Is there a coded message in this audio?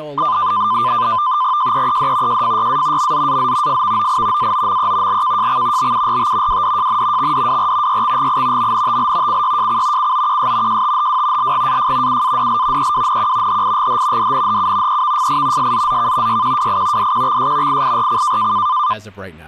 Yes: NAVTEX (SITOR-B), 100 baud, 170 Hz shift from 0.2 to 18.9 s, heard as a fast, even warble, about 1110 Hz centre, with static crashes and speech in English. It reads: JEED JFYA MZAZ FVOI AOME LKJX BURT WDJN XDWR YXGI MNTL CYJC COQS JTHW LGAF UADL EWNQ HIGH DNHU EVFI SZZK YQWI DQXS IIRC